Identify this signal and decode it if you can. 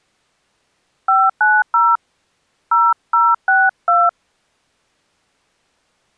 DTMF, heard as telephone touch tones, dialled by hand, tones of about 220 ms. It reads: 590 0062